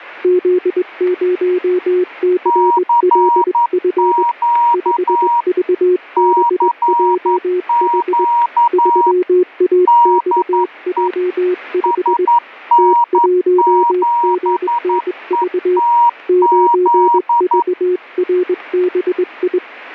Morse code, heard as two keyed tones, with static crashes. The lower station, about 21 wpm, 360 Hz: Z0CLF 5VBJH 3AXJ5 T1GNV 9VRBI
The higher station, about 11 wpm, 950 Hz: CQ CQ DE SN7ETZ